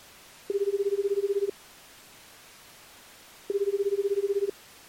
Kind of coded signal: telephone call progress tone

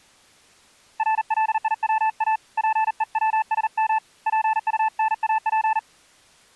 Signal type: Morse code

